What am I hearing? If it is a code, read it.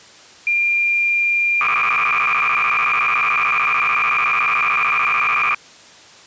Cassette data (Kansas City type), 300 baud, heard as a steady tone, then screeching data.